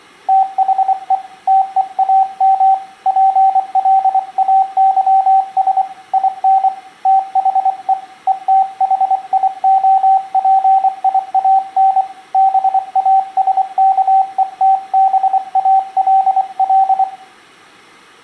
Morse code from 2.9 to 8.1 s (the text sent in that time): PLAYS IN THE